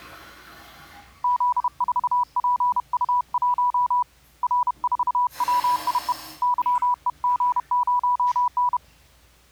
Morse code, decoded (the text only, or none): Z4PU1 R4WIE YEG0N